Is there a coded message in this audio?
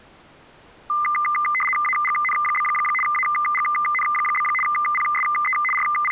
Yes: RTTY (75 baud, 850 Hz shift) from 0.9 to 6.1 s, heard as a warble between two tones, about 1600 Hz centre. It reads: AGN? AGN? PSE …